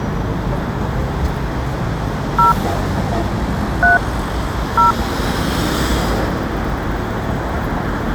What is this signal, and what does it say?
DTMF, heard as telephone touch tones, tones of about 130 ms, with street noise. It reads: 0 3 0